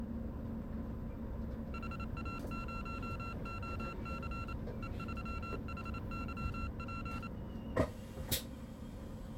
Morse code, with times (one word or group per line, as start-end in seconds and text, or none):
1.7-4.5 HA0OC
4.8-7.3 E3HYP